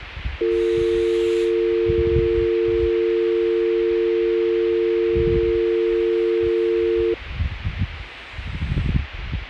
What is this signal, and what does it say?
Telephone call progress tone (North American or UK plan), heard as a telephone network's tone, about 350, 450 Hz, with the noise of a residential street. Dial tone.